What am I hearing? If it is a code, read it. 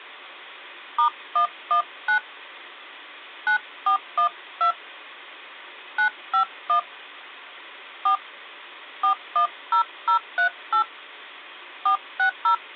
DTMF, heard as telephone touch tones, dialled by hand, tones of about 100 ms. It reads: *119 9412 951 4 410038 460